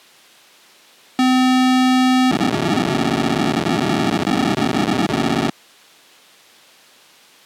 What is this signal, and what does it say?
POCSAG pager data (512 baud), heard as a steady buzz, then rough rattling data.